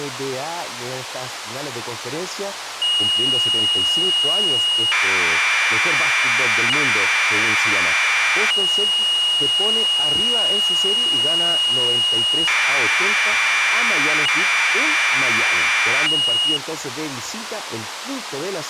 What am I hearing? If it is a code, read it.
Commodore tape loading (standard loader), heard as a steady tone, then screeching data, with tape hiss.